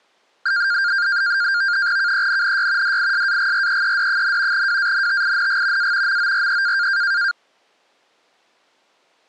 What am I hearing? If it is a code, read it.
NAVTEX (SITOR-B), 100 baud, 170 Hz shift, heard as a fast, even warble, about 1500 Hz centre. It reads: KENNY DISAGREED, WANTING A MORE